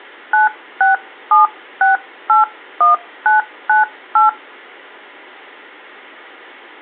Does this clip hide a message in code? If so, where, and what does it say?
Yes: DTMF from 0.3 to 4.3 s, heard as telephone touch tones, dialled by hand, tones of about 140 ms. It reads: 967681998